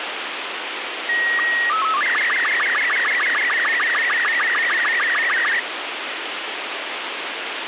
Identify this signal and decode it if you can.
SSTV (slow-scan television), Robot 36, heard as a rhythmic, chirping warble, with radio hiss.